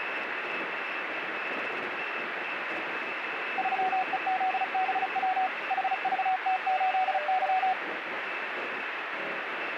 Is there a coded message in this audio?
Yes: Morse code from 3.5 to 7.8 s, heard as a keyed tone, machine-sent, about 35 wpm, 750 Hz, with radio static. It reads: 3EZBW HVT8Y